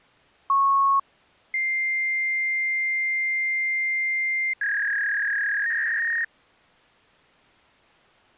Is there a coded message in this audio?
Yes: fax machine handshake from 0.5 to 6.2 s, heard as a beep, a long tone and a warble.